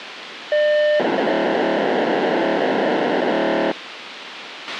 POCSAG pager data (1200 baud), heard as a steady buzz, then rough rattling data, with radio hiss and a squelch burst at the end.